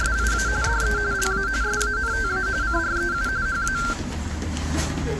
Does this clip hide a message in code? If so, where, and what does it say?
Yes: RTTY (45.45 baud, 170 Hz shift) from 0.0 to 3.9 s, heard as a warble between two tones, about 1470 Hz centre, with static crashes and the noise of a crowd indoors. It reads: … DE LA SANTA CREU HA